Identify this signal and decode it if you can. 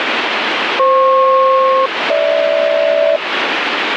Aircraft SELCAL, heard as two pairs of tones, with radio static. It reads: FP-GH